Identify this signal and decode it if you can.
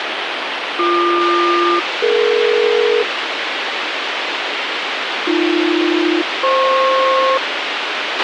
Aircraft SELCAL, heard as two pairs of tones, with radio hiss and a squelch burst at the end. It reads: BQ-DE AB-FP